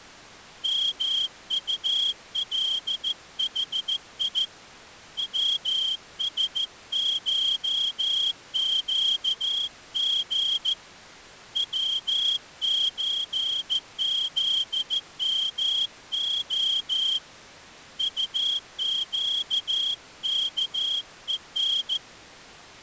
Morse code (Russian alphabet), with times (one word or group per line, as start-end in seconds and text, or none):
0.6-4.4 МУЛХИ
5.2-10.7 ВСШЩГ
11.6-17.2 ВЧЗМО
18.0-22.0 УЩКЕН